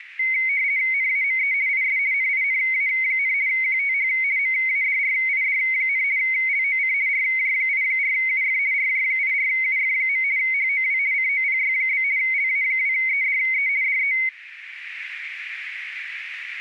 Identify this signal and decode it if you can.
RTTY (50 baud, 170 Hz shift), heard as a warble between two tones, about 2150 Hz centre, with radio static. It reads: NAME IS NINA, QTH MADRID, LOC RJ84UF RJ84UF. HOW COPY? LA2EDE DE